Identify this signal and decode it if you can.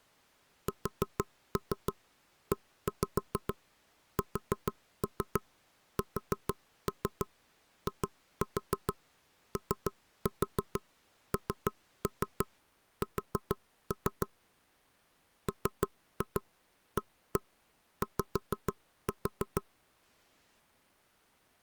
Tap code, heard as knocks on wood, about 6 knocks a second. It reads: SESSIONS MAY